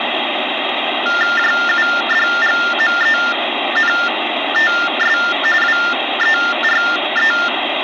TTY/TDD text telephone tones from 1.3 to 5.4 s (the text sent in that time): JUDGMENTS